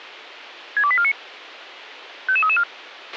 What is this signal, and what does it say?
Five-tone selective call (ZVEI), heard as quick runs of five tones, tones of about 70 ms, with a squelch burst at the end. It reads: 62849 55334